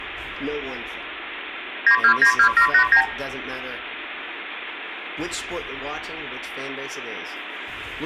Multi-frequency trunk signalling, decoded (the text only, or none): 9292789